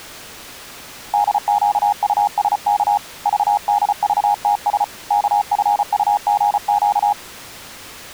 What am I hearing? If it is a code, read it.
Morse code, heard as a keyed tone, hand-sent with a paddle, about 34 wpm, 820 Hz. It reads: DQUSK VDVTS KFUGQ